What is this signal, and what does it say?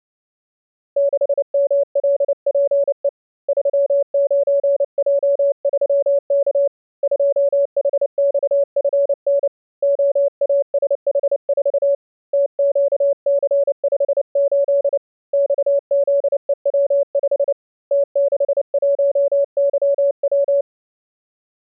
Morse code, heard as a keyed tone, hand-sent with a paddle, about 29 wpm, 560 Hz. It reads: 6MLPE 39J3K 2HXFN OASH4 TQC58 XZEW5 T61YW